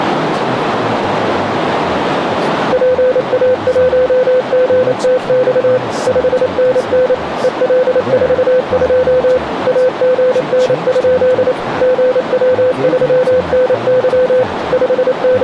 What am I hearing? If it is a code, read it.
Morse code, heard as a keyed tone, machine-sent, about 28 wpm, 510 Hz, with radio static, a narrow filter and speech in English. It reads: PA1GTX 5NN EL42 AGN? GW3NY …